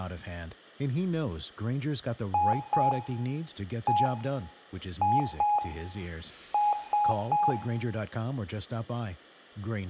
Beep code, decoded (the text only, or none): 2-1-2-3